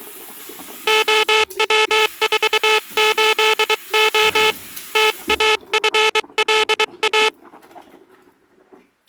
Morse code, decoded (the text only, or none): OW48O TAFLA